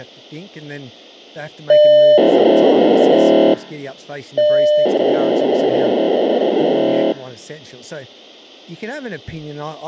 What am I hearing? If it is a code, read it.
POCSAG pager data (1200 baud), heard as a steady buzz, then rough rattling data, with speech in English.